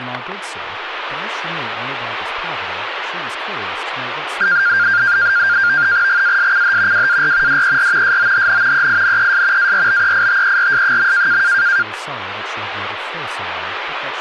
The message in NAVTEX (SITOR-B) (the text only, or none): GASCH WAR DER SOHN EINES ARBEITERS.